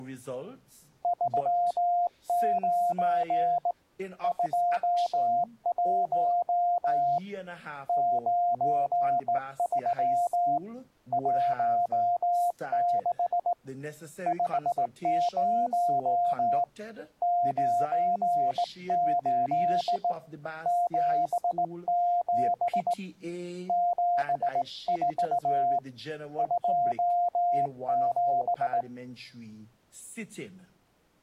Morse code, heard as a keyed tone, hand-sent with a straight key, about 18 wpm, 700 Hz. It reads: 39 21 93 16 50 98 77 74 27